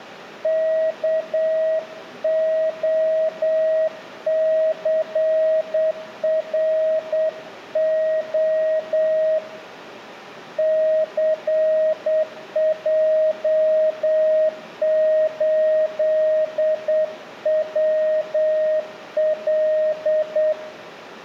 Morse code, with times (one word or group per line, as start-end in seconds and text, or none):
0.4-9.4 KOCRO
10.6-20.5 CJ8WL